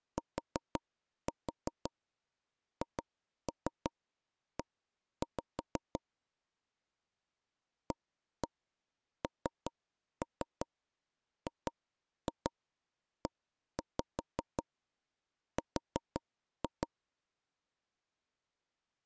Tap code, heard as taps on a table, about 5 knocks a second. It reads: THE ANGER